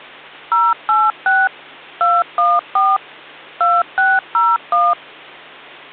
DTMF, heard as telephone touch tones, dialled by machine, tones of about 210 ms, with hum. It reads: 086 214 2601